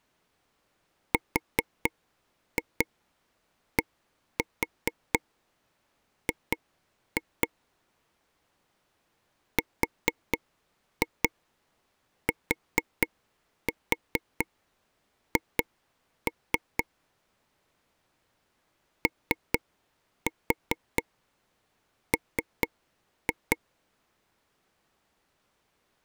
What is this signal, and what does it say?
Tap code, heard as taps on a table, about 4 knocks a second. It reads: RDG RTH OM